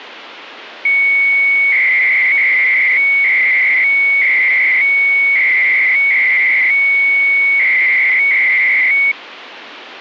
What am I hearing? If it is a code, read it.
300-baud modem data (Bell 103 tones), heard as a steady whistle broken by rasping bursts, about 300 baud, 200 Hz shift, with phone line noise.